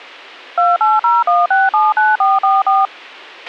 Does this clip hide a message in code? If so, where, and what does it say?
Yes: DTMF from 0.6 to 2.9 s, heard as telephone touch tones, dialled by machine, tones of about 190 ms, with a squelch burst at the end. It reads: 2801679444